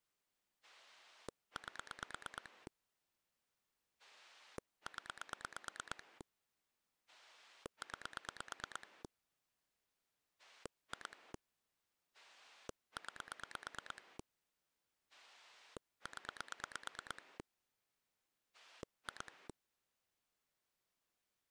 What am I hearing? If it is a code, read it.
Pulse dialling, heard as a rotary dial, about 9 pulses a second. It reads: 8 0 9 2 9 0 2